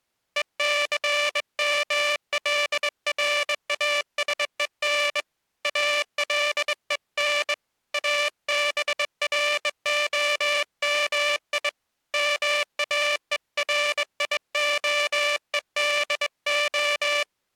Morse code (Hebrew alphabet), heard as a buzzer, hand-sent with a straight key, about 21 wpm. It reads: וסמלראשון אלון אברהמי מאוריהודה